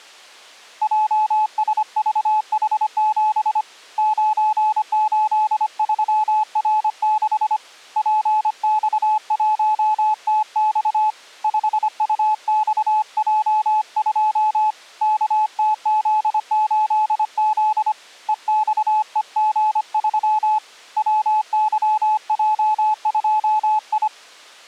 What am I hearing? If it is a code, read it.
Morse code, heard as a keyed tone, hand-sent with a paddle, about 25 wpm, 860 Hz. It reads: JSVH7 983R6 PX1TX 5UXJ2 KTZ8Z EXEG3 WYJ2I